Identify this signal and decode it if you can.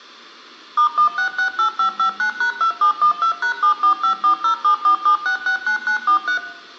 DTMF, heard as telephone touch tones, dialled by machine, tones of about 100 ms, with room echo. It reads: *1668559#2712#74540747669943